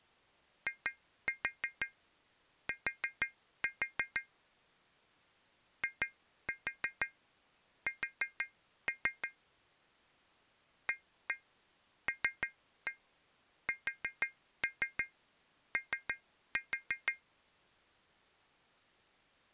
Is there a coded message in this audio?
Yes: tap code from 0.7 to 17.2 s, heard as taps on glass, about 6 knocks a second. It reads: IT IS ALSO